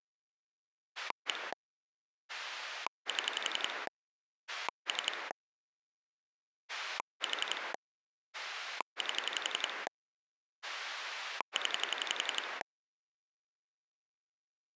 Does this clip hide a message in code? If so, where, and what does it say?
Yes: pulse dialling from 1.0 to 12.6 s, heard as a rotary dial, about 11 pulses a second. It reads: 1 7 3 4 8 0